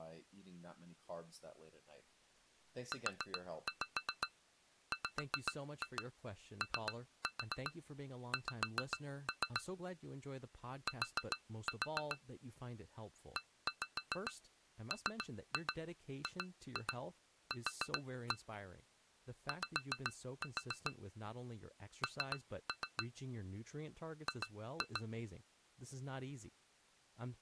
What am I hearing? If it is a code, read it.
Tap code, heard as taps on glass, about 7 knocks a second, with speech in English. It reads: UWOX T EMGQ Y N G